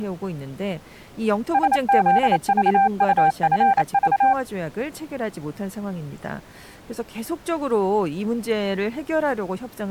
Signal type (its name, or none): Morse code